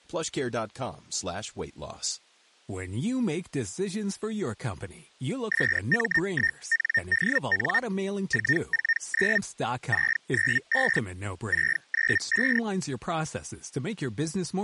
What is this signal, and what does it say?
Hellschreiber (Feld-Hell, 122.5 baud), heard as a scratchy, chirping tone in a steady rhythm, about 1850 Hz, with speech in English. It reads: SM1NDN 449 695 695